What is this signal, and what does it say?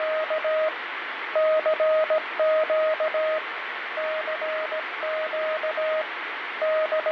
Morse code, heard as a keyed tone, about 17 wpm, 630 Hz, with radio static and fading. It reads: … CQ CQ …